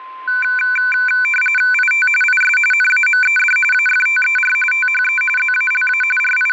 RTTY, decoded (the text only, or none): IT IS NAMED AFTER THE ZALA …